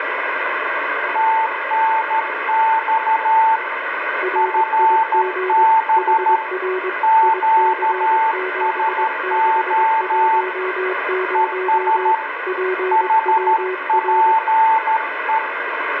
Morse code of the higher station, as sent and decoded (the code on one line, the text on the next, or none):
- -. -..- / ..-. -... / --.- ... --- / . ... / .... .--. .
TNX FB QSO ES HPE